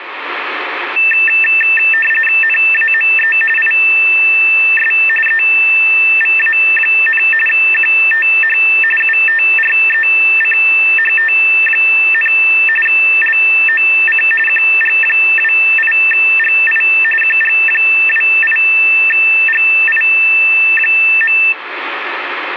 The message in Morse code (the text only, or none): none